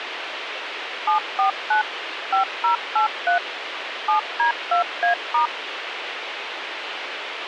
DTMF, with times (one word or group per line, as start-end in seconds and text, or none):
1.1-1.8 749
2.3-3.4 5083
4.1-5.5 7D2A*